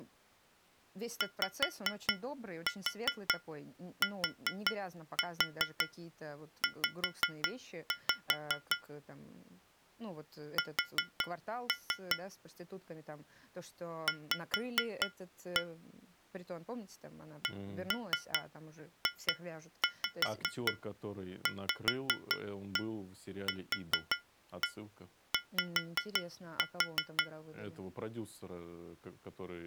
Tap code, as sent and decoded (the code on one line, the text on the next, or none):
5-4 4-4 5-5 / 4-3 / 5-1 / 1-3 2-5 5-1 4-1 5-4
YTZ S V CJVQY